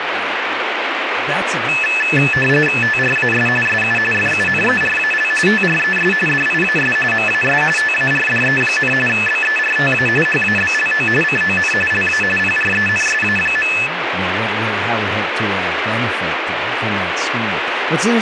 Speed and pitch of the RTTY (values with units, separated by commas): 45.45 baud, 850 Hz shift, 2150 Hz centre